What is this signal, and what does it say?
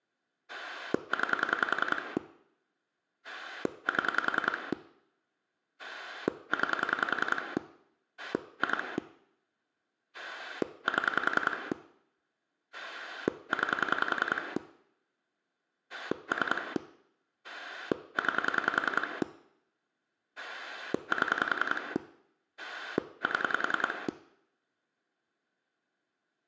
Pulse dialling, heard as a rotary dial, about 10 pulses a second, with room echo. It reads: 9 7 9 2 7 9 3 9 7 7